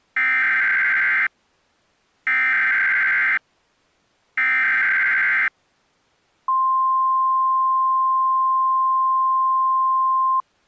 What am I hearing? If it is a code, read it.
Emergency Alert System (SAME) tones (header bursts, then the 1050 Hz attention tone), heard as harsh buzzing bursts, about 520.83 baud.